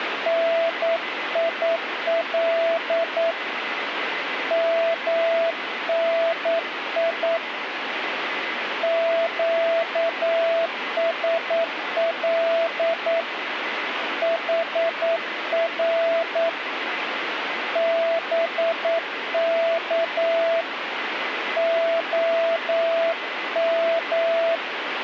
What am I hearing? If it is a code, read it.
Morse code, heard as a keyed tone, hand-sent with a paddle, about 9 wpm, 660 Hz, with radio static and a weaker station near 2020 Hz. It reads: NIL MNI QSL HR BK OM